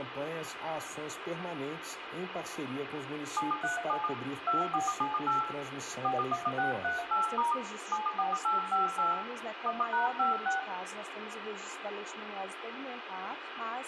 DTMF, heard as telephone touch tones, dialled by machine, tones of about 140 ms, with radio hiss and room echo. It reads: 737 2478 41638* 74858 1#56